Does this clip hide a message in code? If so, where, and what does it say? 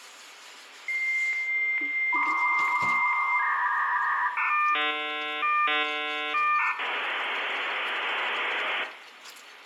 Yes: dial-up modem handshake (V.34 or later) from 0.9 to 8.8 s, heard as a whistle, warbles, then hiss, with phone line noise, room echo and kitchen noise.